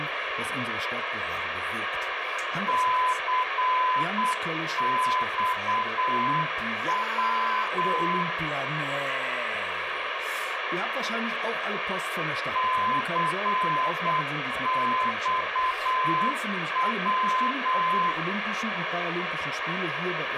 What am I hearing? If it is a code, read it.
Morse code, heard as a keyed tone, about 8 wpm, 1020 Hz, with radio hiss and room echo. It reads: CXW CXW